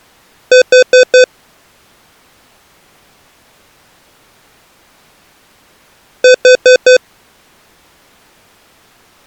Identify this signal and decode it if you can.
Alarm pattern, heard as an alarm's beeps, played twice, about 510 Hz. Temporal four. Carbon monoxide.